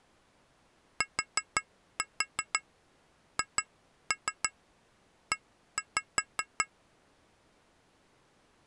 Tap code, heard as taps on glass, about 5 knocks a second. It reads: THE